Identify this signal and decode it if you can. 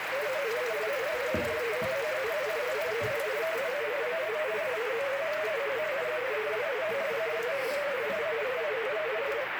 Multi-tone FSK (Olivia or MFSK type), about 250 Hz wide, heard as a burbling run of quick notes, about 31.25 baud, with radio static and kitchen noise.